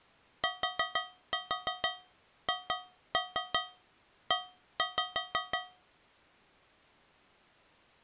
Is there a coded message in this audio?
Yes: tap code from 0.4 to 6.0 s, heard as taps on a metal pipe, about 5 knocks a second. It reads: THE